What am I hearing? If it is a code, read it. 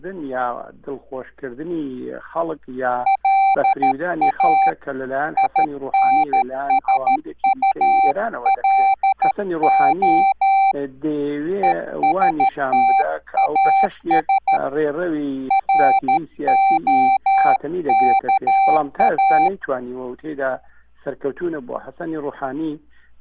Morse code, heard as a keyed tone, hand-sent with a paddle, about 13 wpm, 780 Hz. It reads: LA INSULO ESTAS ROKA